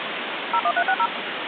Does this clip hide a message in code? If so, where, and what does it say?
Yes: DTMF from 0.5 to 1.1 s, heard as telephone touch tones, dialled by machine, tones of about 60 ms, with phone line noise. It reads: 01360